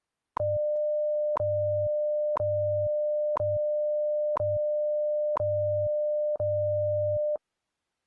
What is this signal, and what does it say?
Radio time signal (WWV, Colorado), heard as ticks, one a second.